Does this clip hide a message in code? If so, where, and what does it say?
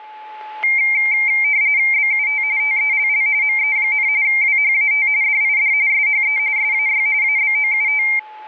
Yes: RTTY (45.45 baud, 170 Hz shift) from 0.6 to 8.2 s, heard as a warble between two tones, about 2200 Hz centre, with static crashes and a steady whistle near 860 Hz. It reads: BUT TELL ME, WHAT DID SHE SAY ABOUT